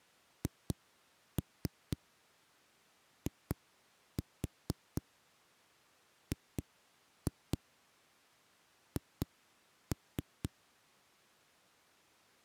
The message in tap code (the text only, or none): HIGH